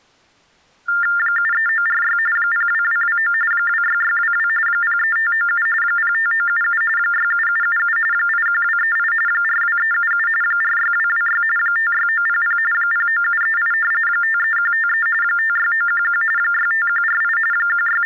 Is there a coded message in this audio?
Yes: TTY/TDD text telephone tones (45.45 baud Baudot) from 0.9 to 18.1 s, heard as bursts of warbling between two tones, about 400 Hz shift, 1600 Hz centre. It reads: 73946 02229 26622 03597 05977 67777 81238 42377 46226 56900 09738 53153 56911 65148 …